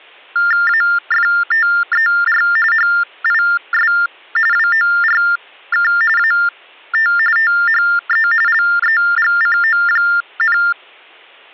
TTY/TDD text telephone tones (45.45 baud Baudot), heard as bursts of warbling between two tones, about 400 Hz shift, 1600 Hz centre. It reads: AFTER HIS WORK AT THE LEGCO,